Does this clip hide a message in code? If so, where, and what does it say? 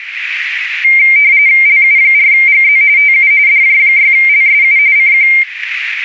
Yes: RTTY (45.45 baud, 170 Hz shift) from 0.8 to 5.4 s, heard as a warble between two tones, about 2200 Hz centre, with radio static. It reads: LU4GZ TU DJ6LSU CQ